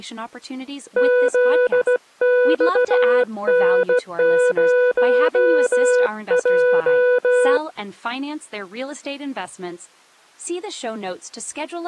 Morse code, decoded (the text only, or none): ZXN0J